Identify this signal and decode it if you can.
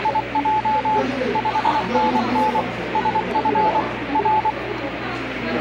Morse code, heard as a keyed tone, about 24 wpm, 860 Hz, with radio static and the noise of a crowd indoors. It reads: … 5NN SF R